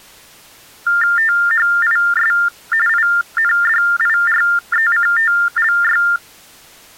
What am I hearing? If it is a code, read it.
TTY/TDD text telephone tones (45.45 baud Baudot), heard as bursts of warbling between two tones, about 400 Hz shift, 1600 Hz centre. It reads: THIS INDIRECTLY